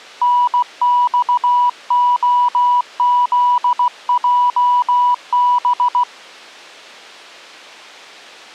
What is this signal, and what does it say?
Morse code (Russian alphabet), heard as a keyed tone, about 16 wpm, 980 Hz. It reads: НЬОЗЙБ